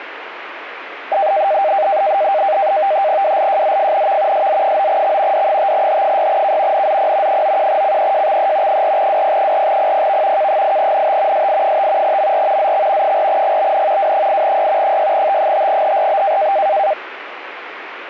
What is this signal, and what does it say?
NAVTEX (SITOR-B), 100 baud, 170 Hz shift, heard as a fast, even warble, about 700 Hz centre, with radio static. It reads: WLJZFNV SZ9X D5H6K NZP 91CEJXE 4WP4PPV K8NT SI5 MR ZX 4GBN W8Y 6T5HRB